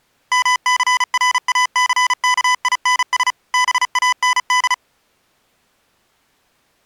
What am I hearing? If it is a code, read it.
Morse code, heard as electronic beeps, machine-sent, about 35 wpm, 1000 Hz. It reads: MCRACKINS BAND